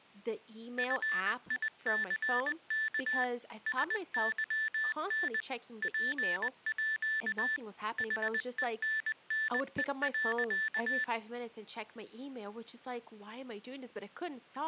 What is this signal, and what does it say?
Morse code (with Swedish letters), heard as electronic beeps, machine-sent, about 20 wpm, 1750 Hz, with speech in English. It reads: FICK SYN PÅ HENNE.